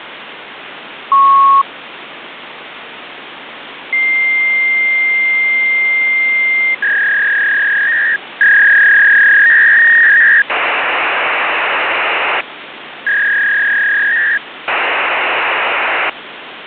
Fax machine handshake, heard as a beep, a long tone, a warble and hiss, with phone line noise.